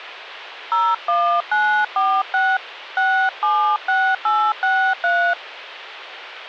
DTMF, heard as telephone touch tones, dialled by hand, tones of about 280 ms. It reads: 01946 676863